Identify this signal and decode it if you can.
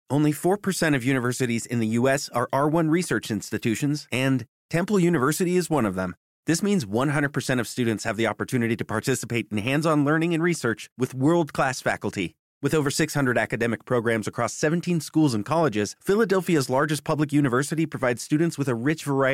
Speech in English. There is no code.